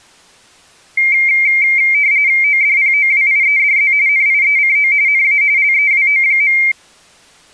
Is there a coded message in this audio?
Yes: RTTY (45.45 baud, 170 Hz shift) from 1.0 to 6.7 s, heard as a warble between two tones, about 2200 Hz centre. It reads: ODPOWIEDZ NIECO NA LEWO.